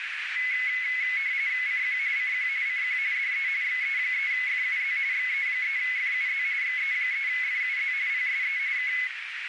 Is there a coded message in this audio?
Yes: RTTY (45.45 baud, 170 Hz shift) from 0.4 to 9.1 s, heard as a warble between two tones, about 2100 Hz centre, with radio static and a narrow filter. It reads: CQ CQ CQ DE XE3FUZ XE3FUZ XE3FUZ PSE K